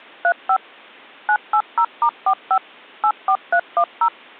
DTMF, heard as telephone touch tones, dialled by machine, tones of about 70 ms. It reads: 35 980*45 84310